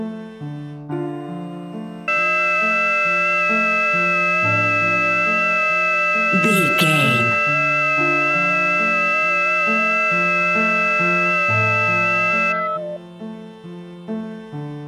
FT8 (several signals at once), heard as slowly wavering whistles, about 6.25 baud.